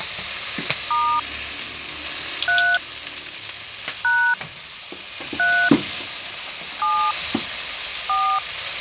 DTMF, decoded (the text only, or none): * 3 # 3 7 4